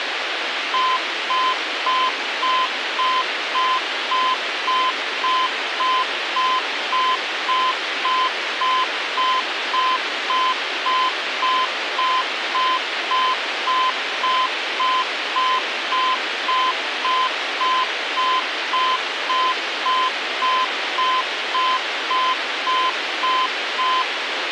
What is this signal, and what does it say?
Evenly repeated beeps, with radio hiss. There is no code.